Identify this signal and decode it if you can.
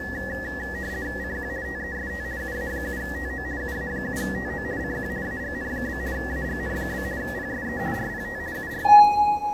RTTY (50 baud, 170 Hz shift), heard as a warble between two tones, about 1800 Hz centre, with the noise inside a lift. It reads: CQ TEST UA7TO UA7TO CQ AGN? AGN? PSE RPT UR